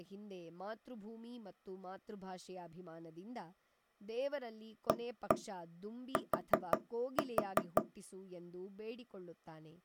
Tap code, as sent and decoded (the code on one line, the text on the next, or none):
1-1 4-4
AT